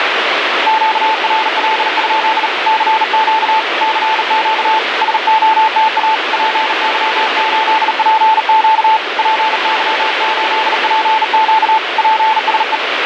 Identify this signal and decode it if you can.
Morse code, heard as a keyed tone, hand-sent with a bug key, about 38 wpm, 880 Hz, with heavy radio static. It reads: QRL? CQ CQ SOTA PY8PQ PY8PQ PSE